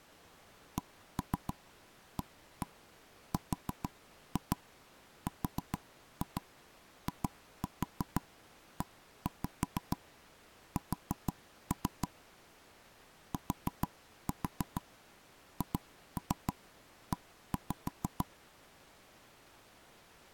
Tap code, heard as knocks on wood, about 6 knocks a second. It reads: CARRIES THE